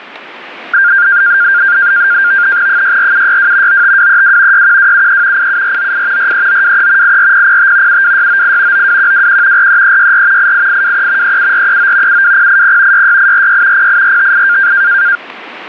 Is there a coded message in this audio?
Yes: NAVTEX (SITOR-B), 100 baud, 170 Hz shift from 0.7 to 15.2 s, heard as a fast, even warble, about 1500 Hz centre, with static crashes. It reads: 64762 95232 61273 87498 43923 84005 72698 92121 43364 88823 37439 72080 66846 08458